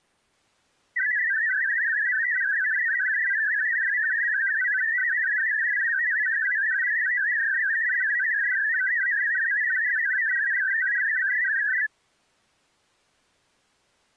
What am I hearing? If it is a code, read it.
Multi-tone FSK (Olivia or MFSK type), about 500 Hz wide, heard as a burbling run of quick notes, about 62.5 baud.